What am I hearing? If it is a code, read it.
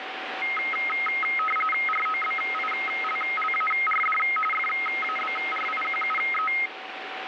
RTTY (45.45 baud, 850 Hz shift), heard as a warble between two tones, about 1700 Hz centre, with radio static and a steady whistle near 760 Hz. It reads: ROBILLARD FABRIQUE